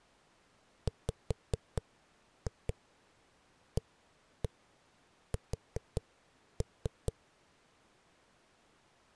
Tap code, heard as knocks on a wall, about 4 knocks a second. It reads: WAS